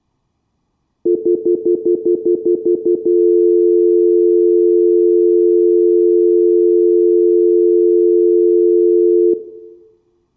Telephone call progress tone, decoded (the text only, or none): stutter dial tone